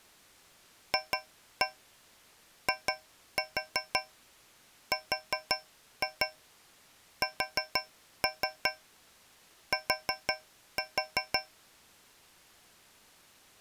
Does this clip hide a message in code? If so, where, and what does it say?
Yes: tap code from 0.9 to 11.6 s, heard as taps on a metal pipe, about 5 knocks a second. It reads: FIRST